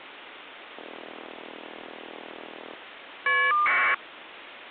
Caller ID data burst, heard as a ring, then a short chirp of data, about 1200 baud, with phone line noise.